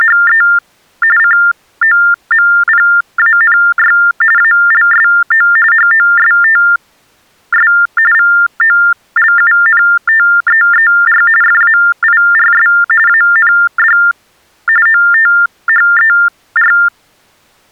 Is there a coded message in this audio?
Yes: TTY/TDD text telephone tones (45.45 baud Baudot) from 0.0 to 16.9 s, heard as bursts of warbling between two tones, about 400 Hz shift, 1600 Hz centre. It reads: … COMPANY ALSO HOSTS VOLUNTEER FAIRS AND OTHER